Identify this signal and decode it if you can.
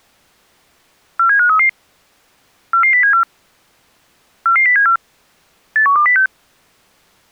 Five-tone selective call (CCIR), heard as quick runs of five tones, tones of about 100 ms. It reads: 47533 44074 44074 81206